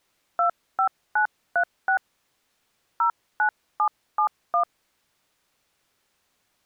DTMF, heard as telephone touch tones, dialled by hand, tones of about 100 ms. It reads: 25936 09771